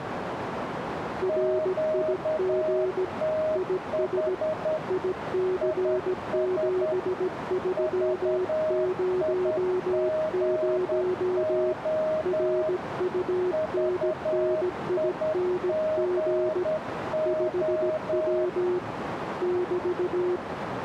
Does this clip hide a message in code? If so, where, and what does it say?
Yes: Morse code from 1.2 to 20.4 s, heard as two keyed tones, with radio static and a narrow filter. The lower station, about 17 wpm, 370 Hz: RIG IS IC7300 RUNNING 5W <BT>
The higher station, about 10 wpm, 620 Hz: QTH IS VIGO VIGO